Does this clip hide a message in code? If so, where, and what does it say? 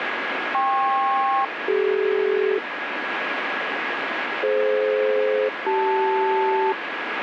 Yes: aircraft SELCAL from 0.5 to 6.7 s, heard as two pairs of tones, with radio static. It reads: KP-CD DF-CL